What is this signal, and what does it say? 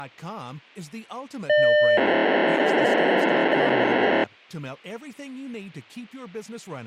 POCSAG pager data (1200 baud), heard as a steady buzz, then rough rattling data, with speech in French.